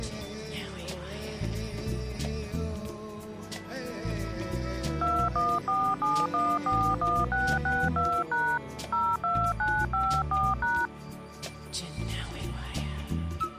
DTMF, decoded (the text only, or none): 2147141662# 02954#